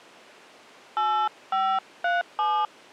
DTMF, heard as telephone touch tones, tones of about 290 ms. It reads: 8537